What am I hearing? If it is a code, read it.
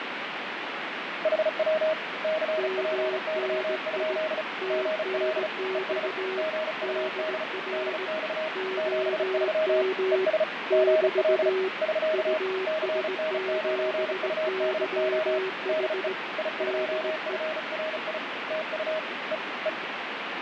Morse code, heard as two keyed tones, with heavy radio static and fading. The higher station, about 35 wpm, 630 Hz: HW CPY? GL ES GUD DX 73 ES GL <SK> CN9UDO DE I2FRI TU E E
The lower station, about 18 wpm, 380 Hz: MNI TNX DR OM <BT> US7YH DE